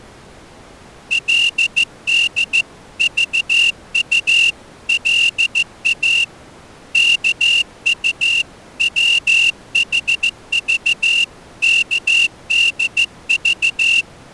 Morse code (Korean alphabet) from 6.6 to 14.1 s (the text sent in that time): 이불을